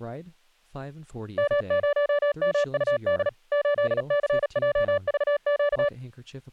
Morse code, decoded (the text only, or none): M0MUD 8CJVQ